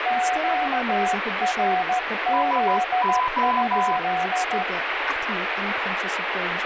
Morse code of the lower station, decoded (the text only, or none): QRZ?